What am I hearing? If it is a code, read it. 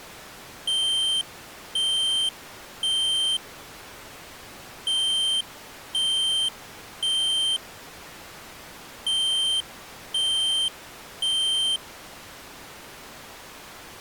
Alarm pattern, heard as an alarm's beeps, played three times, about 3150 Hz. Temporal three. Smoke or fire, evacuate.